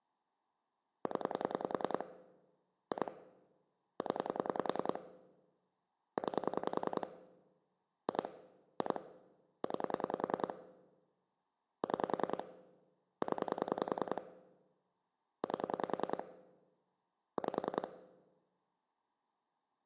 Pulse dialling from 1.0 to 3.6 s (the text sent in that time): 0 2